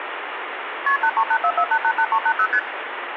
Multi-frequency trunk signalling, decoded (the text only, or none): KP 83844888380 ST